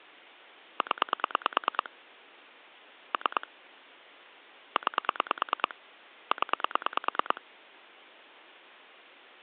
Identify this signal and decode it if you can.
Pulse dialling, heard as clicks on a phone line, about 9 pulses a second. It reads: 0 3 9 0